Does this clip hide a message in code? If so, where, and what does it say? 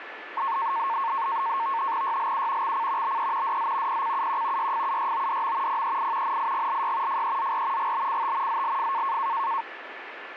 Yes: NAVTEX (SITOR-B), 100 baud, 170 Hz shift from 0.4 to 9.6 s, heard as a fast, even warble, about 1000 Hz centre, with radio static and a steady whistle near 1740 Hz. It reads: YLU XC BE DZ PCUQ YFUYODM PEI NIGLY FEZR GBCT ZLF